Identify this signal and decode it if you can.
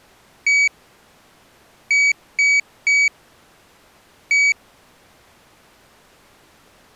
Beep code, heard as a piezo beeper, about 2250 Hz. 1-3-1. In Phoenix BIOS tables: memory refresh failure.